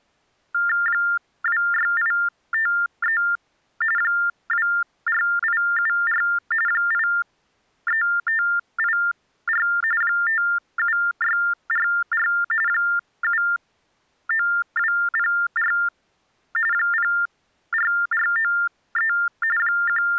TTY/TDD text telephone tones (45.45 baud Baudot), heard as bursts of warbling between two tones, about 400 Hz shift, 1600 Hz centre. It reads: 26853 24874 83584 57644 79204 04493 …